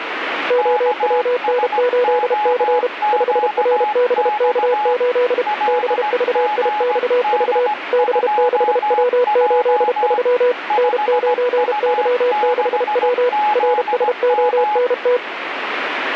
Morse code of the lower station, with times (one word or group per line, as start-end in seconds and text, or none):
0.5-2.9 OWN8C
3.1-5.4 5RBK8
5.7-7.7 BVIXV
7.9-10.5 B6W83
10.8-13.3 N9Y6W
13.6-15.2 RSONT